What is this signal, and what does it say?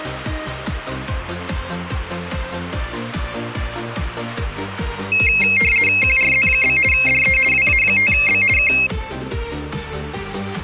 RTTY (50 baud, 450 Hz shift), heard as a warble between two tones, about 2350 Hz centre. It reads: QRZ? DE WA5B K